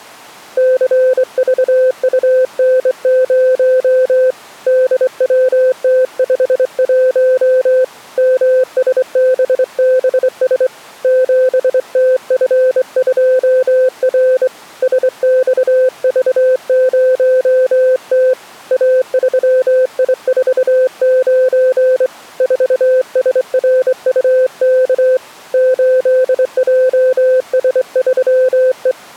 Morse code, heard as a keyed tone, hand-sent with a straight key, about 24 wpm, 510 Hz. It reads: CVUN0 DWT51 MSBBS 7TF2R SXV0T A3I49 4SRUK 8JS3E